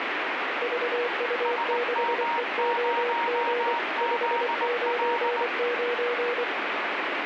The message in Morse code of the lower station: VU6EOG 599

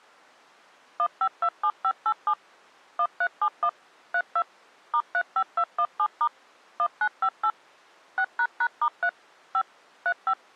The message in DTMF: 1527587 1371 32 *35217* 1958 6##*3 5 35

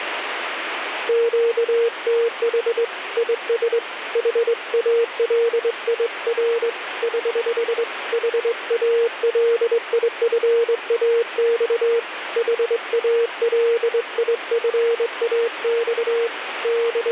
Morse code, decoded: QTH IS HALIR <HH> HALIFAX HALIFAX …

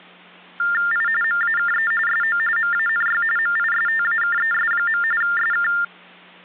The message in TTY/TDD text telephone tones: I MAKE SO MANY MISTAKES. SK

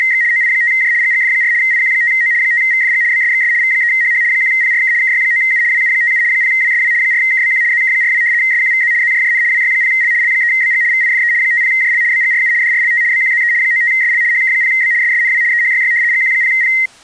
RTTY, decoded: … OI5J GGF4 IQ5O 5VFG BSXS V3HH 1PRK KY9U WU57 0WSW 4KBQ ZK42 SQVZ ZJJN WY0L L3BG VIFE 50JL BGRU DRLT BQZE 95SL HK0B SSNW EHYY GQ0P

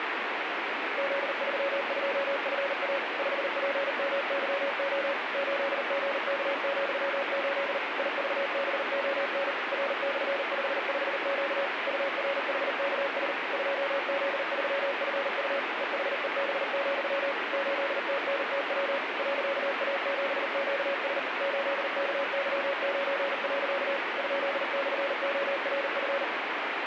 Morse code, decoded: Z32FA 5PMYO 8GK,8 IVBON R/55Q URHKS 2Z3FU EHEB, 8TNTW .A7QS 8KY9. ?/ORF

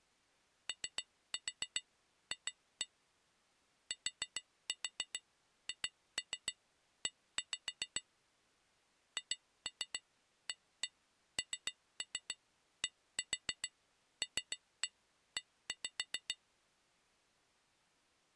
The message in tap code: OF THE HANDLE

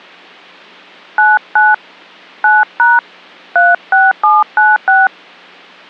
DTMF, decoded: 99 9# 36796

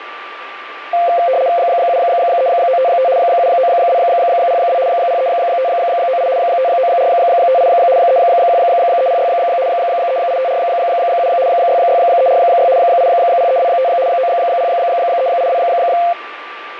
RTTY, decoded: 73955 79202 03598 59458 31306 38547 66346 80325 90382

